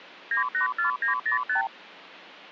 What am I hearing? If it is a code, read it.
Multi-frequency trunk signalling (R2, with the far end's replies), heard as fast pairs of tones, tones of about 120 ms. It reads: 984905